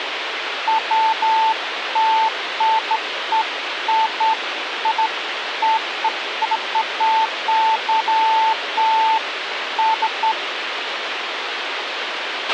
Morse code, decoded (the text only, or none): none